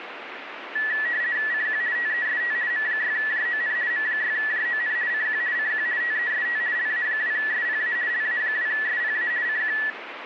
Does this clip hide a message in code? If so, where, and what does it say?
Yes: RTTY (50 baud, 170 Hz shift) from 0.8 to 9.9 s, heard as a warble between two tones, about 1850 Hz centre, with radio static. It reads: CQ TEST M6JON M6JON CQ CQ TEST LA2SPA LA2SPA CQ